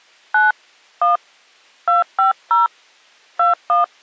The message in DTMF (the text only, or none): 9 1 250 21